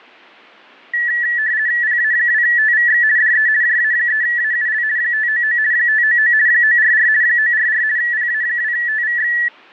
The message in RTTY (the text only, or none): PA2TVX DE JA3AUL 599 599 944 944 PA2TVX